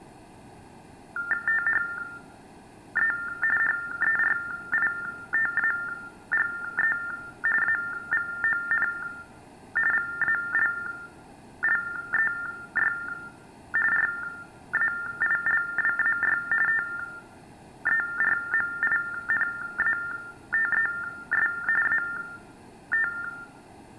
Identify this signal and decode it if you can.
TTY/TDD text telephone tones (45.45 baud Baudot), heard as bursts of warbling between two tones, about 400 Hz shift, 1600 Hz centre, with room echo. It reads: THE HERITAGE AVON VALLEY RAILWAY TERMINATES AT